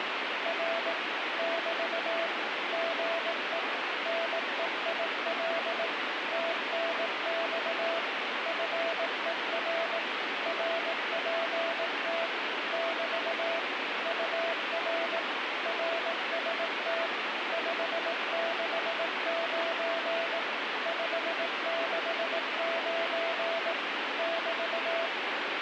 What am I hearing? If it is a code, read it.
Morse code, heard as a keyed tone, machine-sent, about 18 wpm, 670 Hz, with heavy radio static. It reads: R <BT> GE NEIL TNX FER RPT <BT> UR RST 569 569 <BT>